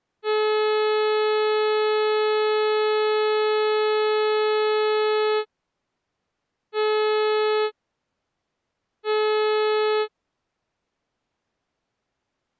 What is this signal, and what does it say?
Ship horn signal, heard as a ship's horn, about 430 Hz. 1 long, 2 short. At sea: a vessel in fog that is sailing, fishing, towing or hampered.